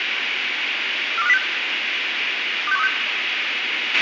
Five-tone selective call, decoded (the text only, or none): 42506 26136